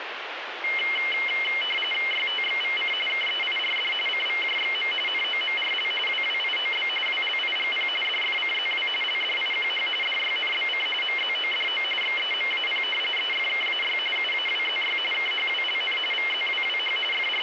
RTTY (45.45 baud, 850 Hz shift), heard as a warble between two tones, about 2550 Hz centre, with radio static. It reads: YTXVC KEIRD CVJXM NOMRL WWIOB WLIGP DFCZW LDIQH DYNBC MZODO XEMAP EFKAY UAWZY KHWLN VZWWH …